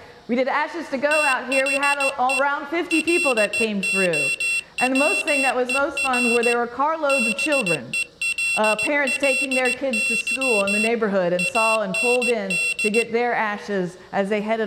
Morse code, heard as a high beeper, hand-sent with a straight key, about 16 wpm, 2700 Hz. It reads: THE LOWER BELLY AND